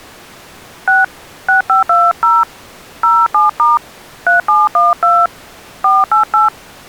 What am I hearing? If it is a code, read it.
DTMF, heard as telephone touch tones, dialled by hand, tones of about 170 ms. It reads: 6 6520 07* 3712 488